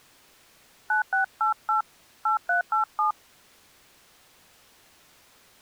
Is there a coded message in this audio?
Yes: DTMF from 0.9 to 3.1 s, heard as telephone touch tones, dialled by hand, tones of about 120 ms. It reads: 9688 8387